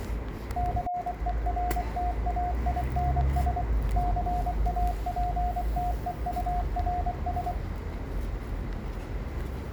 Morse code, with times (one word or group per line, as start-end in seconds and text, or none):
0.6-3.6 CERTAINS
4.0-7.5 CAPTEURS